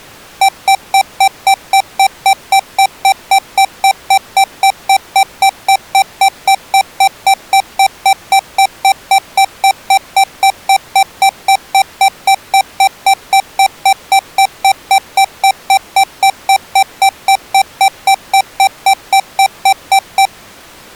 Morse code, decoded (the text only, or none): none